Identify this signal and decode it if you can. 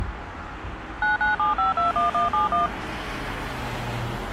DTMF, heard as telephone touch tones, dialled by machine, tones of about 140 ms, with street noise. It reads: 997521171